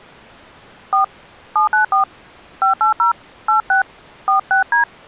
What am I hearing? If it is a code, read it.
DTMF, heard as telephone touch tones, dialled by hand, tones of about 120 ms. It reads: 4 794 580 86 46D